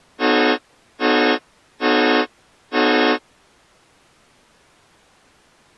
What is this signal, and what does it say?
Train horn signal, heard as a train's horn. 4 short. On North American railways: a request for a signal to be given or repeated.